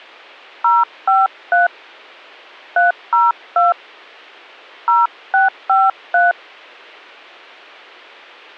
DTMF, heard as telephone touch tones, dialled by hand, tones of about 170 ms. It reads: 053 302 0653